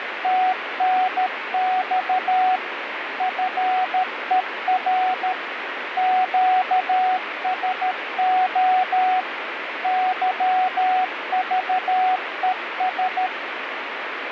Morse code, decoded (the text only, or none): TNX FER QSO YVES